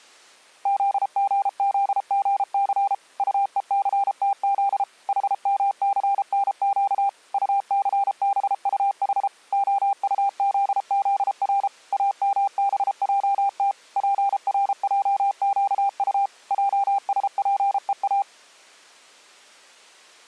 Morse code (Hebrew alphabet), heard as a keyed tone, machine-sent, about 33 wpm, 800 Hz. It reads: זגזגס טוסתז חמסנק טסבטח הטזזר אמבעת פרעקט עשפוא